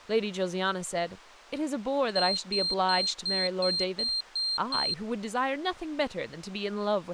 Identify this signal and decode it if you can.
Beep code, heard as a piezo beeper, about 4200 Hz, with speech in English. 8 short. In AMI BIOS tables: display memory failure; in Dell tables: LCD failure.